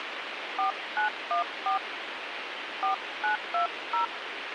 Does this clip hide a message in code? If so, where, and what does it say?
Yes: DTMF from 0.6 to 4.0 s, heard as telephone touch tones, dialled by hand, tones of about 120 ms, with radio hiss. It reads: 4914 4920